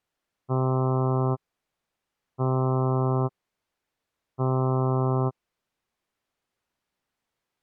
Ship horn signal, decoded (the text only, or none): 3 short